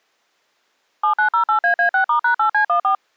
DTMF, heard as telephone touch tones, dialled by machine, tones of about 100 ms. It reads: 7908AA6*#8C14